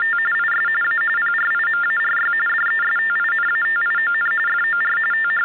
TTY/TDD text telephone tones (45.45 baud Baudot), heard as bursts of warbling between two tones, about 400 Hz shift, 1600 Hz centre, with hum. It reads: … IS A PRIMARY DESTINATION FOR …